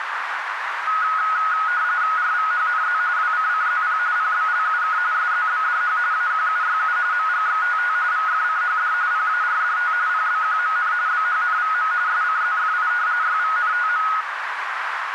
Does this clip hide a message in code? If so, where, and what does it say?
Yes: RTTY (45.45 baud, 170 Hz shift) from 0.9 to 14.2 s, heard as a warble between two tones, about 1360 Hz centre, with radio static and a narrow filter. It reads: RVHNZ WCCZP PBLUK SZBDH AQUYU MGXTT VFCHD PARDT PBQMN BHNVM SCZFI YVNTM